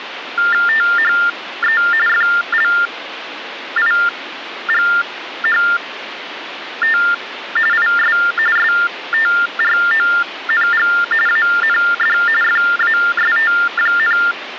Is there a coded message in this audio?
Yes: TTY/TDD text telephone tones (45.45 baud Baudot) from 0.4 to 14.3 s, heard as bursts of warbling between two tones, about 400 Hz shift, 1600 Hz centre, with phone line noise. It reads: THE FLIGHT IS STRONG AND FAST,